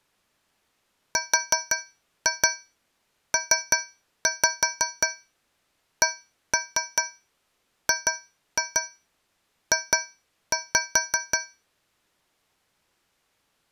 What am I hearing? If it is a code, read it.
Tap code, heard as taps on a metal pipe, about 5 knocks a second. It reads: RPCGJ